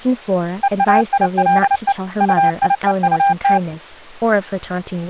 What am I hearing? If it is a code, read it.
Morse code (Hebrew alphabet), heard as a keyed tone, machine-sent, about 29 wpm, 800 Hz, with speech in English. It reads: ואילו טיוטת